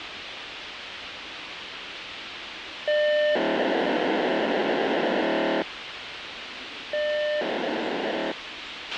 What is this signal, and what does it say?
POCSAG pager data (1200 baud), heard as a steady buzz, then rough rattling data, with radio hiss, a squelch burst at the end and the noise of a subway station.